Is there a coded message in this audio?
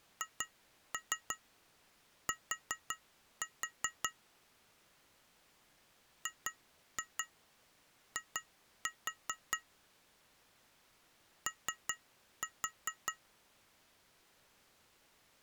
Yes: tap code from 0.2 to 13.2 s, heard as taps on glass, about 5 knocks a second. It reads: HT GI O